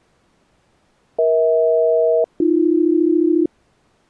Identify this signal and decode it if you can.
Aircraft SELCAL, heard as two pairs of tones. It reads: EH-AB